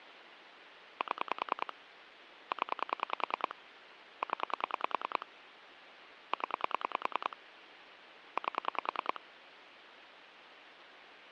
Pulse dialling, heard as clicks on a phone line, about 10 pulses a second, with phone line noise. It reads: 7 0 0 0 8